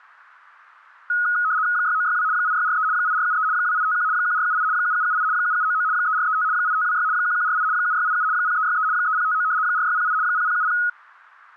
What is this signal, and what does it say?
RTTY (75 baud, 170 Hz shift), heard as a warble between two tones, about 1360 Hz centre. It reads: 6962 8643 8473 2851 1478 7778 7799 3435 8526 1148 7687 0363 3059 4608 0070